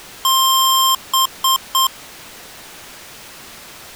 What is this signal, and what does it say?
Beep code, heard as beeps from a small speaker, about 1060 Hz. 1 long, 3 short. In Award and IBM BIOS tables: video adapter failure; in AMI BIOS tables: memory failure.